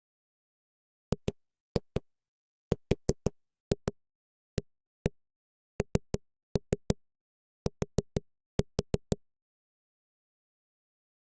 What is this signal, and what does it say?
Tap code, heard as knocks on a wall, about 6 knocks a second. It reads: GRANT